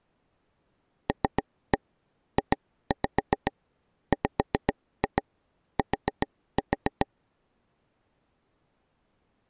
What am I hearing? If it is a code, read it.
Tap code, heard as taps on a table, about 7 knocks a second. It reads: LJWT